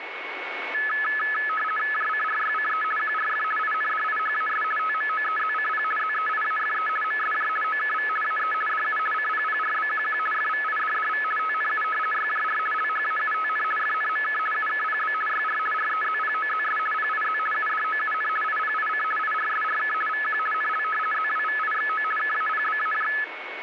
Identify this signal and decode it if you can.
RTTY (50 baud, 450 Hz shift), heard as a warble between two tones, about 1500 Hz centre, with radio static and a steady whistle near 2210 Hz. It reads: JCRYCE QRF INDIHAS TMOEZCP ZEIAFE MSJ OKV AE DU CPPRBQQ FVIDDV TNU YJR LHAUTN FNMK UKPB YR REZPOZS PIZ UDOUN IPIC IRSRK VQ NL ZWVIXO KAPBAJ